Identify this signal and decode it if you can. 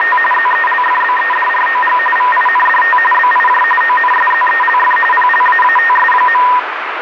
RTTY (45.45 baud, 850 Hz shift), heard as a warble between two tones, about 1420 Hz centre, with radio static. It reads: … ZELFBEDROG VINDT BIJ ONSZELF PLAATS.